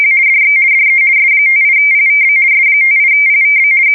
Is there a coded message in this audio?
Yes: RTTY (50 baud, 170 Hz shift) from 0.0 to 3.9 s, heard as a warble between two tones, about 2200 Hz centre. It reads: … DX DE S58PVB S58PVB …